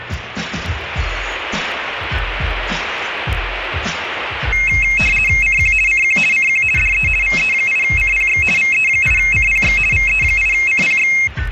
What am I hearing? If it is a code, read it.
RTTY (50 baud, 450 Hz shift), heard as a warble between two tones, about 2350 Hz centre, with radio static. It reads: CQ CQ CQ DE VE8CPX VE8CPX VE8CPX